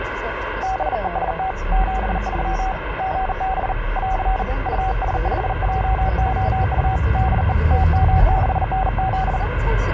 Morse code, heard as a keyed tone, hand-sent with a bug key, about 39 wpm, 760 Hz, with radio static and the noise inside a car. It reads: BEST 73 GB <AR> US5JOU DE TM6NZ